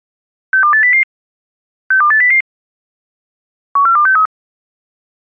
Five-tone selective call (CCIR), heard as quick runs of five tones, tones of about 100 ms. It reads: 62800 62800 14263